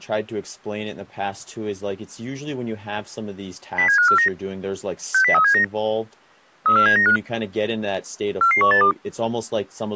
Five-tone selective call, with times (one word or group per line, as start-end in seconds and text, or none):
3.8-4.3 07549
5.1-5.6 60379
6.7-7.2 34795
8.4-8.9 44182